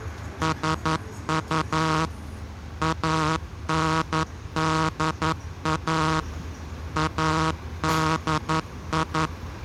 Morse code, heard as a buzzer, machine-sent, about 11 wpm, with street noise. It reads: SU ANDA ADI